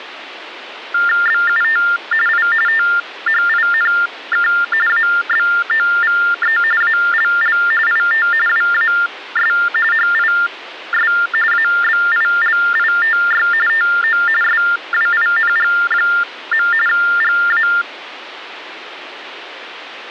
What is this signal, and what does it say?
TTY/TDD text telephone tones (45.45 baud Baudot), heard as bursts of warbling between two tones, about 400 Hz shift, 1600 Hz centre, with phone line noise. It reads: BUT I THINK ABOVE ALL IT WAS HIS ABILITY TO SWING. GA